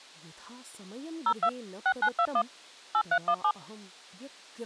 DTMF, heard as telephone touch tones, dialled by machine, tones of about 70 ms, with speech in Sanskrit. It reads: 02 6921 8317